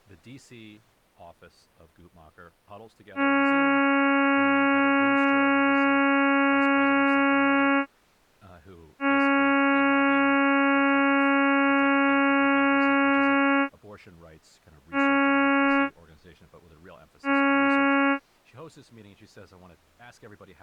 Ship horn signal, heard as a ship's horn, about 280 Hz, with speech in English. 2 long, 2 short. At sea: I intend to overtake on your port side.